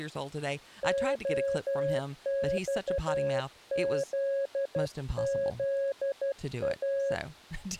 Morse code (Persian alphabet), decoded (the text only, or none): عخززا